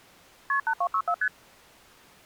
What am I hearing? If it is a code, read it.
Multi-frequency trunk signalling (R1, as on North American trunks), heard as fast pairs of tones, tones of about 70 ms. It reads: KP 8264 ST